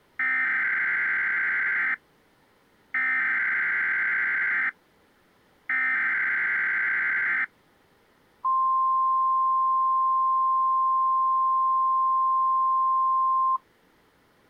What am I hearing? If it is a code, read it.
Emergency Alert System (SAME) tones (header bursts, then the 1050 Hz attention tone), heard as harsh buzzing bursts, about 520.83 baud.